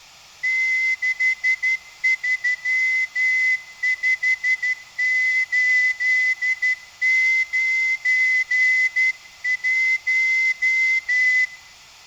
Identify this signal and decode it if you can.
Morse code, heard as a whistle, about 12 wpm. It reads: 635891